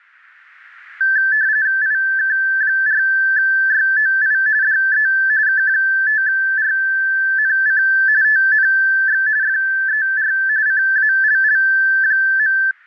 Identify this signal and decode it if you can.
RTTY (45.45 baud, 170 Hz shift), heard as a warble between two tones, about 1650 Hz centre. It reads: IK4YOI DE K5RNC TNX FER CALL.